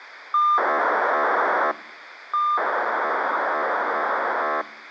POCSAG pager data (2400 baud), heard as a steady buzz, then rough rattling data, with radio hiss.